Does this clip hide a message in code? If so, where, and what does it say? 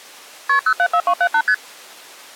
Yes: multi-frequency trunk signalling (R1, as on North American trunks) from 0.5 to 1.5 s, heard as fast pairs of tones, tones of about 70 ms. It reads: KP 074278 ST